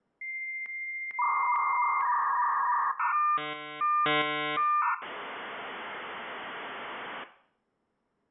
Dial-up modem handshake (V.34 or later), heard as a whistle, warbles, then hiss, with room echo.